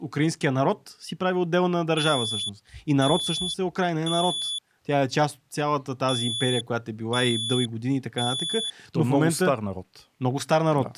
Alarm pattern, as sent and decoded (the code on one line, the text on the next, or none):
3 beeps and a pause
temporal three